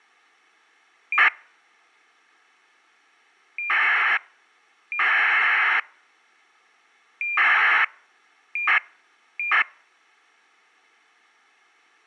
ACARS aircraft data, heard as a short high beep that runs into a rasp, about 2400 baud.